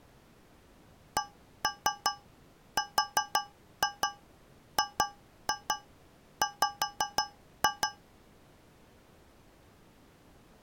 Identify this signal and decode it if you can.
Tap code, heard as taps on a metal pipe, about 5 knocks a second. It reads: CRGW